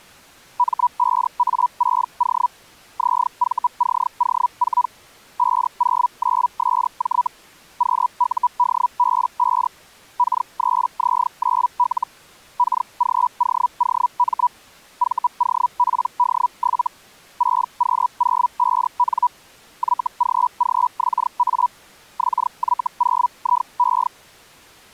Hellschreiber (Feld-Hell, 122.5 baud), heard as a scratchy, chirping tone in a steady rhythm, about 980 Hz. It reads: M5A6O ZVCO4 509SJ QUDB5 K3Z9L KGOOM VOPD7 6Q05N YGGXA XY0IE